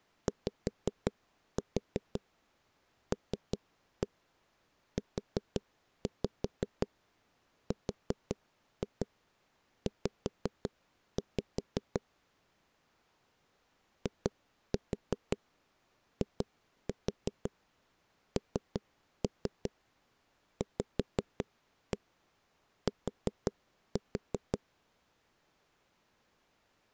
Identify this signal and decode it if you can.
Tap code, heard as knocks on a wall, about 5 knocks a second. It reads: YLURZ IINVT